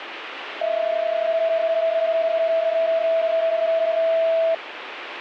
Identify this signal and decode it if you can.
PSK31 (31.25 baud), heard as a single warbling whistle, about 660 Hz, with radio static.